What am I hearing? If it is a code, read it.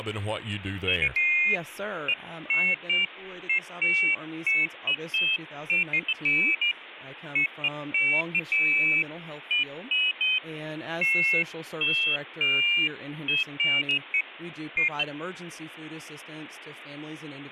Pairs of high tones at irregular times, with phone line noise and speech in English. There is no code.